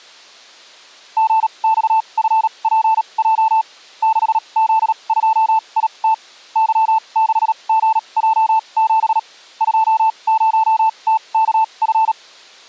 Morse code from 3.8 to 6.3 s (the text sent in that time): 6Z2IT